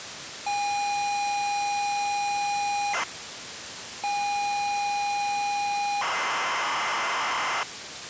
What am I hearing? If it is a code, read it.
ZX Spectrum tape loading, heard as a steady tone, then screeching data, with tape hiss.